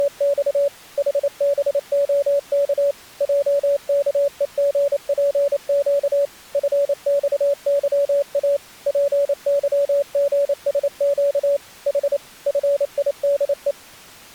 Morse code, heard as a keyed tone, machine-sent, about 28 wpm, 570 Hz. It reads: … HBOK JKEGPQ FXYA PYGSQ H FIDE